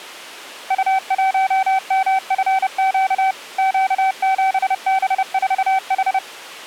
Morse code, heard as a keyed tone, machine-sent, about 30 wpm, 770 Hz. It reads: U1MFQ Q7B4H